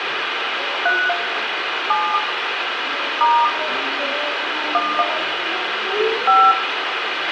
DTMF, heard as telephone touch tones, dialled by hand, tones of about 240 ms, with radio hiss, a squelch burst at the end and room echo. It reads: 3 7 * 1 5